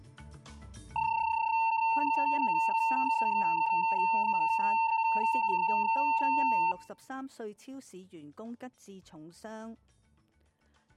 PSK31 (31.25 baud), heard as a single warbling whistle, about 900 Hz.